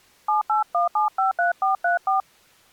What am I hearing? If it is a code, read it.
DTMF, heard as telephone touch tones, dialled by hand, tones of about 130 ms. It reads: 781753434